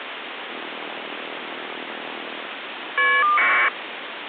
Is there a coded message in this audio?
Yes: caller ID data burst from 0.5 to 3.7 s, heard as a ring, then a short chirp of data, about 1200 baud, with phone line noise.